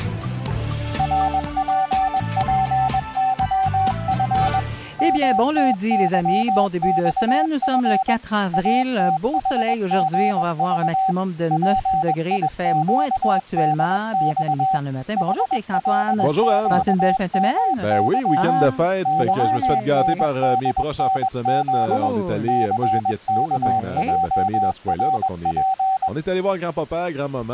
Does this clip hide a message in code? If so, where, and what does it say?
Yes: Morse code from 0.9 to 26.1 s, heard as a keyed tone, machine-sent, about 21 wpm, 770 Hz. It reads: RPPYF MTYXF ATHGV PIQDX HLQMY YNDNZ CKJRP